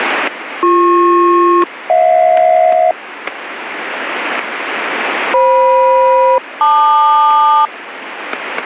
Aircraft SELCAL, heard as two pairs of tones, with static crashes. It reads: BP-HJ FM-LQ